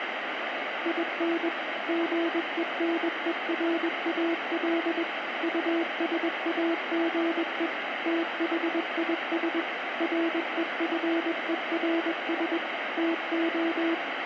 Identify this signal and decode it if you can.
Morse code, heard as a keyed tone, machine-sent, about 21 wpm, 330 Hz, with radio static and room echo. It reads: IN GENERAL USAGE THIS REFERS TO